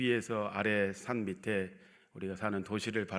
Speech in Korean. There is no code.